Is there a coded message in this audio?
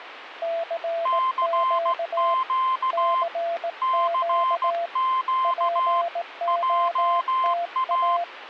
Yes: Morse code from 0.4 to 8.3 s, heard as two keyed tones, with radio static. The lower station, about 18 wpm, 680 Hz: CQ CQ POTA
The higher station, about 16 wpm, 1040 Hz: CQ CQ JA